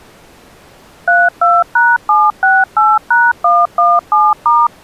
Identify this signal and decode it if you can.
DTMF, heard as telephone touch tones, dialled by machine, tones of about 210 ms. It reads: 32#768#117*